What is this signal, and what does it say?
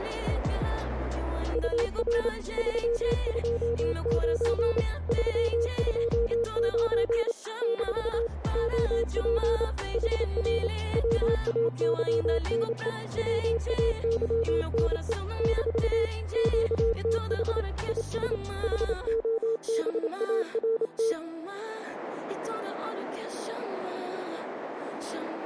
Morse code, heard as a keyed tone, hand-sent with a paddle, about 28 wpm, 460 Hz, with radio static. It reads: UR 329 329 - OP HR WAYNE WAYNE - QTH IS HOBART